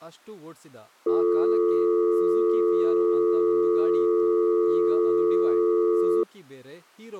Telephone call progress tone (North American or UK plan), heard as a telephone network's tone, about 350, 440 Hz, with speech in Kannada. Dial tone.